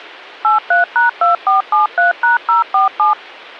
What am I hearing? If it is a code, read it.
DTMF, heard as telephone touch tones, dialled by machine, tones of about 140 ms. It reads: 83#2473#047